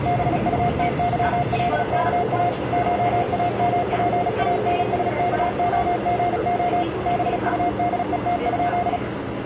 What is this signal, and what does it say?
Morse code (Russian alphabet), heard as a keyed tone, machine-sent, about 36 wpm, 710 Hz, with the noise inside a subway train. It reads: БУТЫЛКА ШАМПАНСКОГО БУДЕТ?